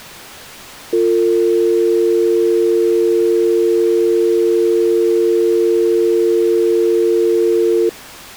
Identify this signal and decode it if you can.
Telephone call progress tone (North American or UK plan), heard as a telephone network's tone, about 350, 450 Hz. Dial tone.